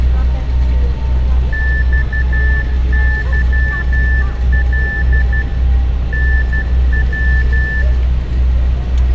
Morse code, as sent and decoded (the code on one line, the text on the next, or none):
-..- -.-- .-.. / -. .--
XYL NW